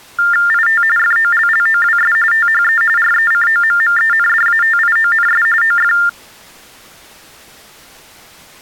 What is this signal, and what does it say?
TTY/TDD text telephone tones (45.45 baud Baudot), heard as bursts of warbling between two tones, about 400 Hz shift, 1600 Hz centre. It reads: IT FOLLOWS THE RECOMMENDATIONS OF